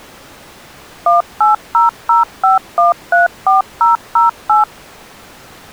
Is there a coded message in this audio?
Yes: DTMF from 1.1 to 4.6 s, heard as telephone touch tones, dialled by machine, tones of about 140 ms. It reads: 18005134008